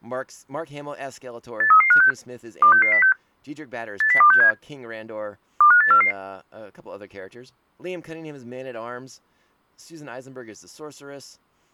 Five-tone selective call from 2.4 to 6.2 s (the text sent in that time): 26606 80267 25844